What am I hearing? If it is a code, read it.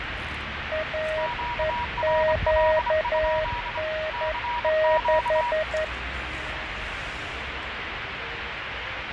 Morse code, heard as two keyed tones, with radio static, fading and street noise. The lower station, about 11 wpm, 630 Hz: AEQN6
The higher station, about 25 wpm, 960 Hz: QRL? CQ